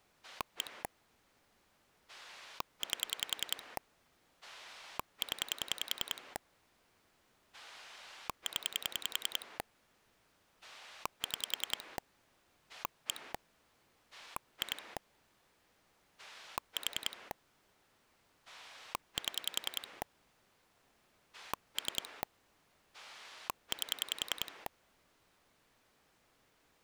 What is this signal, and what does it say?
Pulse dialling, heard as a rotary dial, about 10 pulses a second. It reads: 1 8 0 0 6 1 2 4 7 3 8